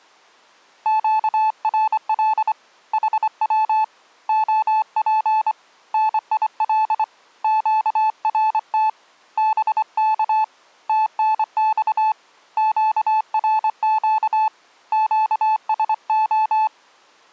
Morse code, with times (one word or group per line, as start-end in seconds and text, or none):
0.9-2.5 QRL
2.9-3.8 HW
4.3-5.5 OP
5.9-7.0 NIL
7.4-8.9 QRT
9.4-10.4 BK
10.9-12.1 TNX
12.6-14.5 QRQ
14.9-16.7 QSO